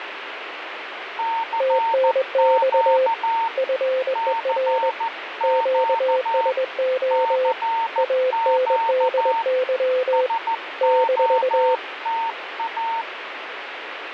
Morse code, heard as two keyed tones, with radio static. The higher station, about 14 wpm, 910 Hz: CQ CQ CQ SOTA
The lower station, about 21 wpm, 520 Hz: TNX FER QSO ANDY -